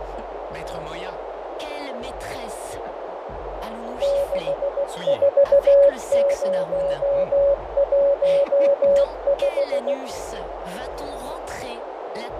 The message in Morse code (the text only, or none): 64015